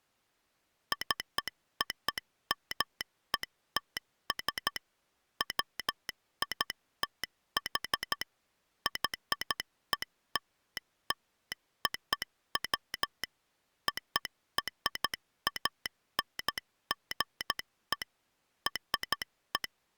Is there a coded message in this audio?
Yes: Morse code (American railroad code) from 0.9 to 20.0 s, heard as a telegraph sounder, machine-sent. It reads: COMETS WITH YELLOW ORANGE …